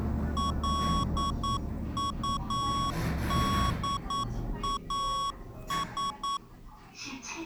Morse code, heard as electronic beeps, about 9 wpm, 1110 Hz, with the noise inside a lift. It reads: LUDAS